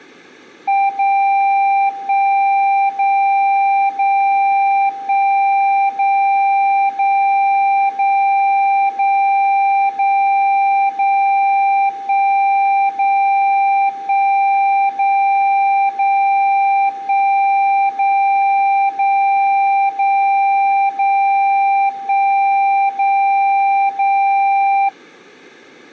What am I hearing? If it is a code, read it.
Radio time signal (DCF77), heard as a tone whose level steps once a second, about 790 Hz. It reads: 0 1 0 0 1 0 0 0 0 0 0 1 0 1 0 0 1 0 0 0 0 1 0 0